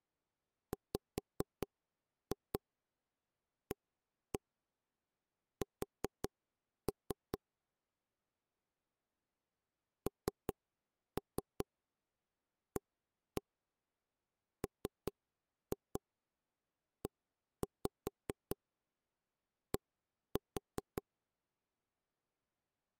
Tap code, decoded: WAS NAMED

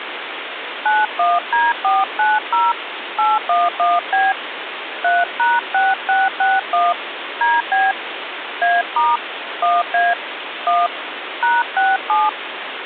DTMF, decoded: 91D490 811B 3#6661 DB A* 1A 1 #67

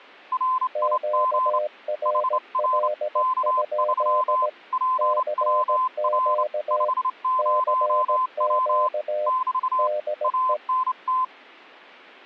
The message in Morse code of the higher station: RIG HR K3 PWR 50W <BT> ANT

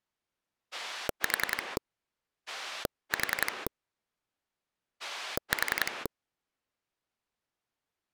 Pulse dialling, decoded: 4 4 4

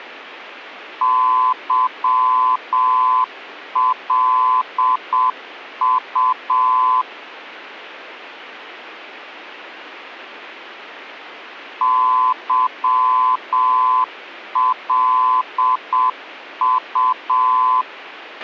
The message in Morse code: YLU YLU

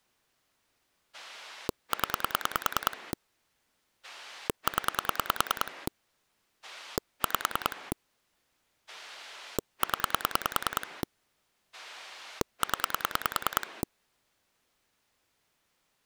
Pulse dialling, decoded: 0 0 5 0 0

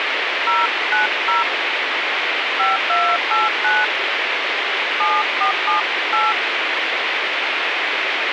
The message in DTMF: 090 5289 7478

